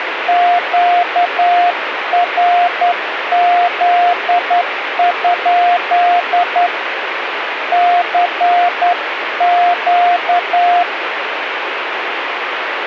Morse code, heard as a keyed tone, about 10 wpm, 710 Hz, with radio static. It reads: QRZ? CQ